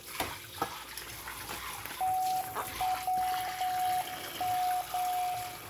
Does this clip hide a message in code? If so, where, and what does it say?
Yes: Morse code (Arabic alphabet) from 1.9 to 5.4 s, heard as a keyed tone, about 9 wpm, 740 Hz, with room echo and kitchen noise. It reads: توم